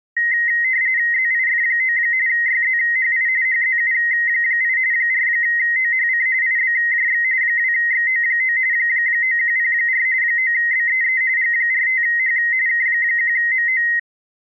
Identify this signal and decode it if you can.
RTTY (45.45 baud, 170 Hz shift), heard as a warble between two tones, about 1950 Hz centre. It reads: ZIF9 YZHI HZU8 4OHC IBJX 2XO9 9104 9BEE G45H K1MO